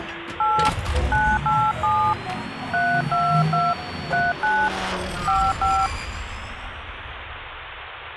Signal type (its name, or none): DTMF